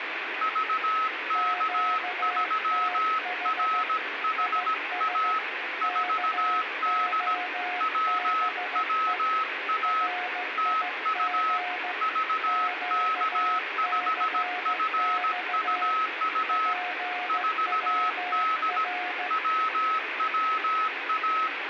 Morse code, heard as two keyed tones, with radio static and room echo. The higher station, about 17 wpm, 1290 Hz: VK3RHA 4D WWA TU VK5FUU 4D WWA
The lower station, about 15 wpm, 720 Hz: QTH IS KOBE RIG QCX PWR